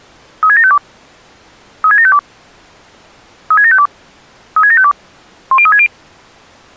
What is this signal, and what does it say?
Five-tone selective call (ZVEI), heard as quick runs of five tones, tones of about 70 ms. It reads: 36752 36752 36752 36752 10360